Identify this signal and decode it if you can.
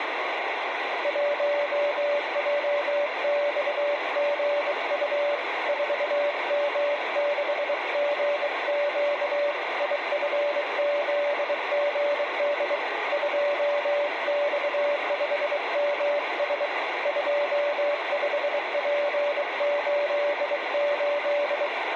Morse code, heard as a keyed tone, hand-sent with a bug key, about 23 wpm, 580 Hz, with radio static. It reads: 1JXGU 4M6GQ IFZGD 2X5MS 25P88